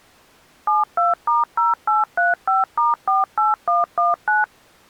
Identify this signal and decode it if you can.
DTMF, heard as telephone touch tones, dialled by machine, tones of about 160 ms. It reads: 72*0835*48119